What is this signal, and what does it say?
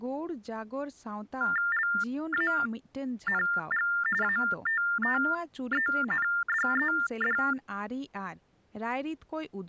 TTY/TDD text telephone tones (45.45 baud Baudot), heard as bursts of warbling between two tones, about 400 Hz shift, 1600 Hz centre, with speech in Santali. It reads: LANG ATTENDED